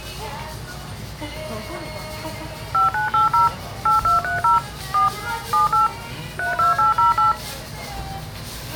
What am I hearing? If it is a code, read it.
DTMF, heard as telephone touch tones, dialled by machine, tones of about 140 ms, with the noise of a restaurant. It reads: 5980 8230 4 78 32808